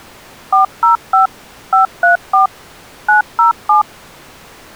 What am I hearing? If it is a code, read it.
DTMF, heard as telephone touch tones, dialled by machine, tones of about 130 ms. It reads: 405 534 907